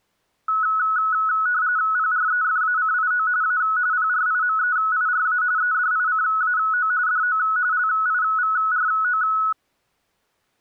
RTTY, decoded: PREFACIO A PRIMEIRA EDICAO DO LIVRO

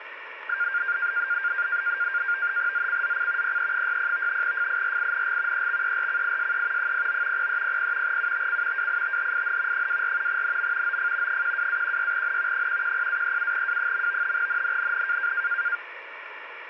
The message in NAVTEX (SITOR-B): ZCZC PE60 FIRING EXERCISE 09 0300 UTC WITHIN 24 NM OF 12-16N 110-37W. NNNN

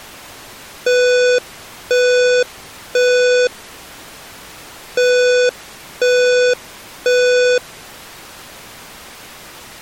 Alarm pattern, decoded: temporal three

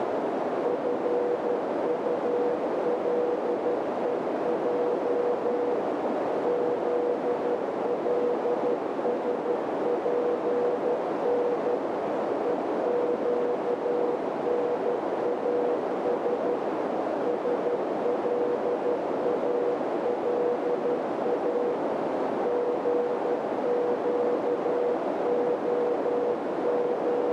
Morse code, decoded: FULEJ ZLSPN EQNAS SLALA …

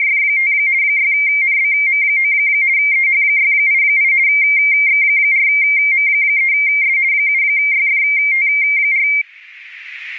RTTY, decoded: … 6NBM9 EH688 X4M3S 7YFT4

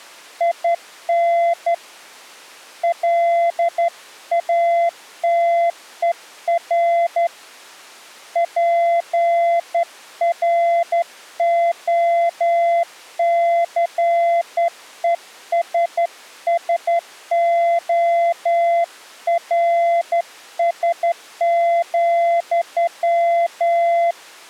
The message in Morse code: IN LATER PROCESSORS,

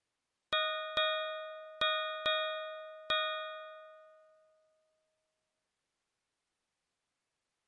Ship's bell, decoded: 5

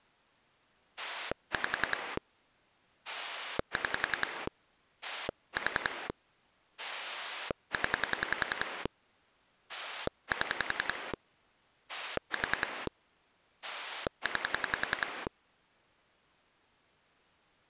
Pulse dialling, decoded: 5 6 4 0 7 4 9

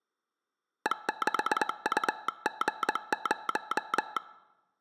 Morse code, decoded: E6UG0

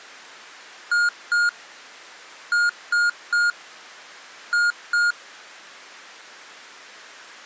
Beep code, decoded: 2-3-2

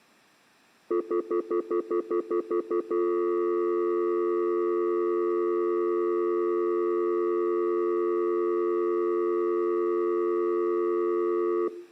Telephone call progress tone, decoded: stutter dial tone

